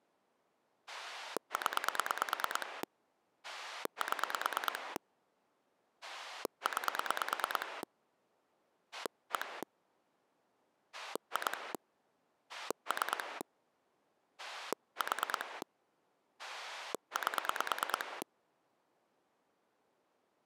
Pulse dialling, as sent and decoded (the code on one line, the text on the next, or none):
10 / 7 / 9 / 1 / 2 / 3 / 4 / 8
0 7 9 1 2 3 4 8